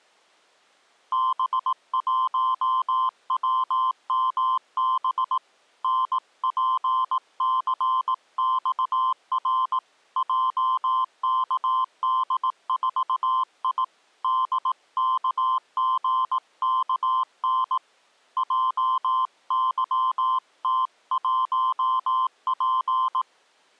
Morse code, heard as a keyed tone, hand-sent with a paddle, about 18 wpm, 1040 Hz. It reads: B1WMB NPCXR JKD4I DKGKN JYT1P